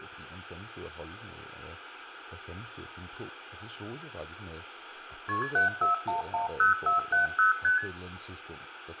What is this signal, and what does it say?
Multi-frequency trunk signalling (R1, as on North American trunks), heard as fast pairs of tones, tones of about 130 ms, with phone line noise, room echo and speech in Danish. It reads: KP 74110470 ST